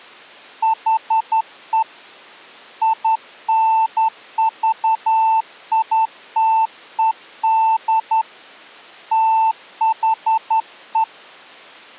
Morse code, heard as a keyed tone, hand-sent with a straight key, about 11 wpm, 890 Hz. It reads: HE INVITED THE